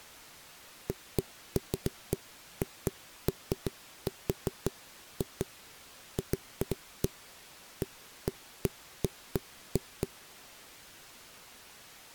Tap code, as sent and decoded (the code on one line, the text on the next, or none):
none